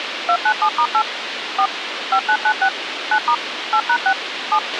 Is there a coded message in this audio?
Yes: DTMF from 0.3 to 4.6 s, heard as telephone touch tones, dialled by machine, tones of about 70 ms, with radio hiss and a squelch burst at the end. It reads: 297*8 4 5996 9* 8#6 7